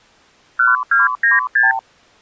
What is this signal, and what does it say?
Multi-frequency trunk signalling (R2, with the far end's replies), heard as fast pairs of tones, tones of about 160 ms. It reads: 1296